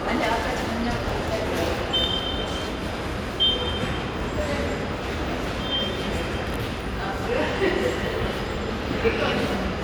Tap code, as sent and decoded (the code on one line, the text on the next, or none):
none